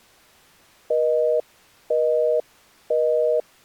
Telephone call progress tone (North American plan), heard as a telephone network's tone, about 480, 620 Hz, 0.5 s on and 0.5 s off. Busy tone.